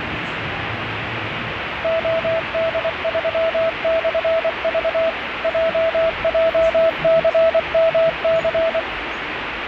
Morse code, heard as a keyed tone, machine-sent, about 24 wpm, 660 Hz, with radio static and the noise inside a subway train. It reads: OD3/V JJCMC